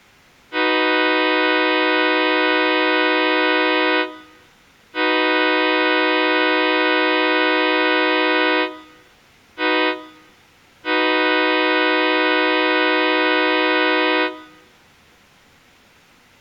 Train horn signal, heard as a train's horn, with room echo. 2 long, 1 short, 1 long. On North American railways: approaching a public crossing.